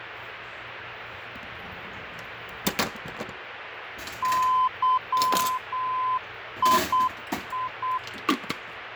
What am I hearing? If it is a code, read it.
Morse code, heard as a keyed tone, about 8 wpm, 1020 Hz, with radio static, fading and kitchen noise. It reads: YII